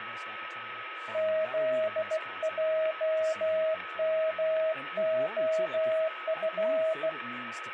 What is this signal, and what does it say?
Morse code, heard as a keyed tone, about 16 wpm, 640 Hz, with radio static, a steady whistle near 1280 Hz and speech in English. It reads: ZJMOF